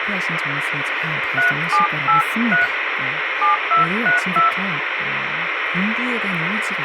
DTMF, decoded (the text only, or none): 3783 7232